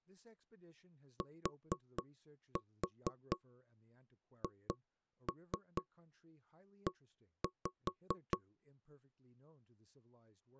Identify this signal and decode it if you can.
Tap code, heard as knocks on wood, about 4 knocks a second, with speech in English. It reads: THE